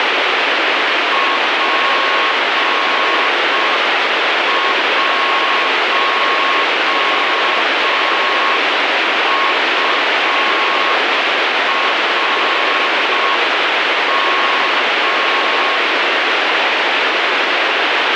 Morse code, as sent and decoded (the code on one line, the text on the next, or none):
.--. .---- ..- .-. --
P1URM